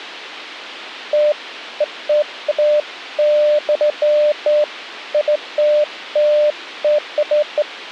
Beeps of irregular length, with a squelch burst at the end. There is no code.